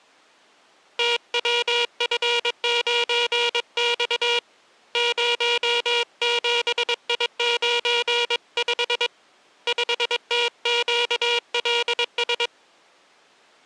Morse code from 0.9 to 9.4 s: TWF9X 07I95

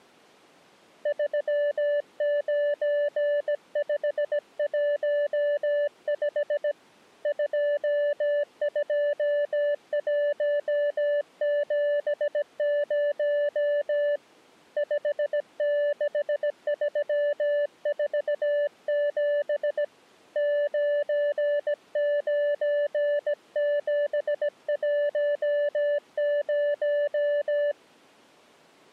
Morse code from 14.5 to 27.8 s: 56347 99710

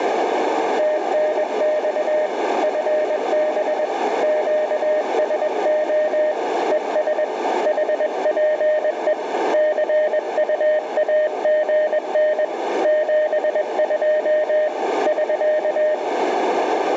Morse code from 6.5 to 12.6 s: ES HPE CUAGN

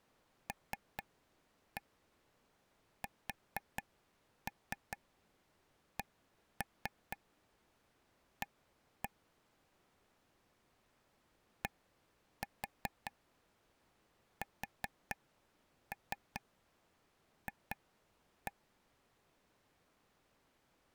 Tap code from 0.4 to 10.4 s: LSCA

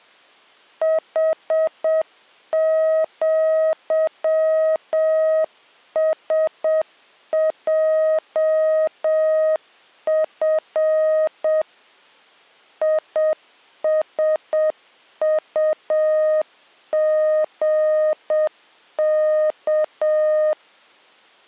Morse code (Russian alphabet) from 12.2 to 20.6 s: ИСУГК

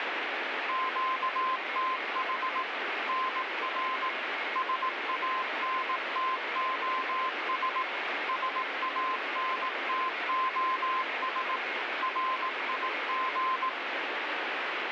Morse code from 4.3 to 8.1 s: SANTOS

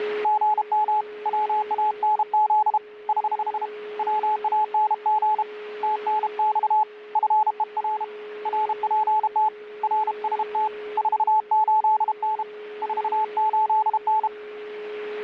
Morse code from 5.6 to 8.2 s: TNX FER

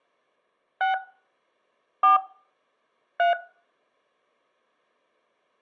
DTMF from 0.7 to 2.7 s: 6 4

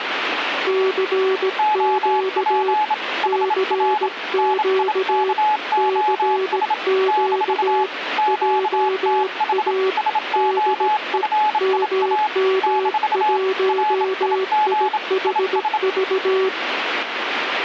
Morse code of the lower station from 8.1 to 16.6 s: JA DE MM1IHV

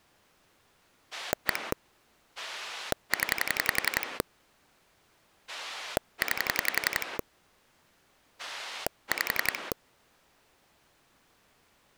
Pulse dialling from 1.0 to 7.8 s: 1 0 9

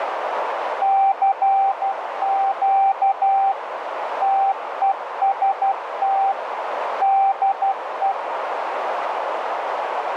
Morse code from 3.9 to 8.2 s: TEST DE

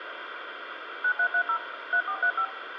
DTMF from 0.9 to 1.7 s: 9330

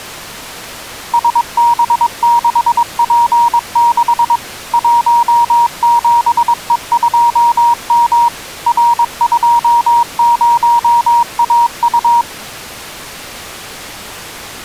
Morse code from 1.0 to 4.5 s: SB6P6

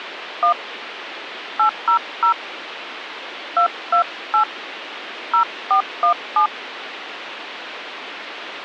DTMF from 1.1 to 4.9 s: 800 228

